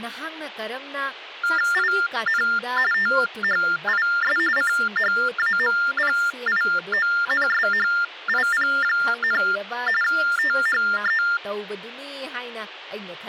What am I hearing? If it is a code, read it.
TTY/TDD text telephone tones (45.45 baud Baudot), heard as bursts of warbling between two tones, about 400 Hz shift, 1600 Hz centre, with speech in Manipuri. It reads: IN THIS CHAMPIONSHIP, THE